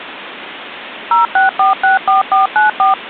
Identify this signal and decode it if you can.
DTMF, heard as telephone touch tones, dialled by machine, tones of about 140 ms, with phone line noise. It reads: 06464494